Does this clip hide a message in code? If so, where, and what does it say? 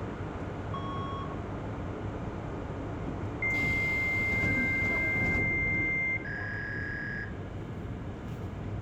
Yes: fax machine handshake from 0.7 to 7.2 s, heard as a beep, a long tone and a warble, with room echo and the noise inside a subway train.